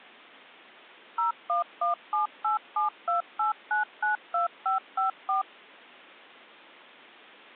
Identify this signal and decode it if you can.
DTMF, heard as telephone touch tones, dialled by machine, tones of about 130 ms. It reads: 01178728992554